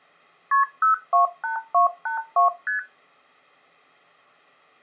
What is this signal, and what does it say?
Multi-frequency trunk signalling (R1, as on North American trunks), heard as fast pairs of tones, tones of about 120 ms. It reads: KP 028282 ST